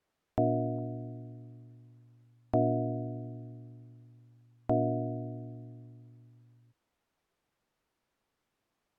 Clock strike, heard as a bell. 3. Three o'clock.